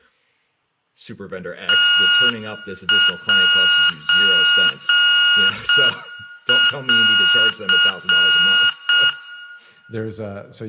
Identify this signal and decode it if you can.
Morse code (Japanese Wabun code), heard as electronic beeps, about 6 wpm, 1430 Hz, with room echo and speech in English. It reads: ムセン